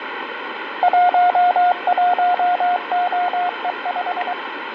Morse code, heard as a keyed tone, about 23 wpm, 720 Hz, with radio static and fading. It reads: 11OE5